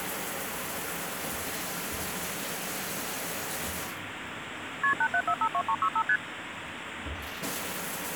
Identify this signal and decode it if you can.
Multi-frequency trunk signalling (R1, as on North American trunks), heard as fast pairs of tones, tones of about 70 ms, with phone line noise and the noise of a restroom. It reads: KP 87452365 ST